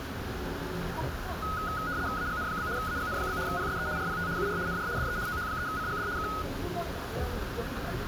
RTTY (75 baud, 170 Hz shift), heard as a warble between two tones, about 1360 Hz centre, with radio static, a narrow filter and the noise inside a bus. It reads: AGN? AGN? PSE RPT UR NR DE OH3CGD K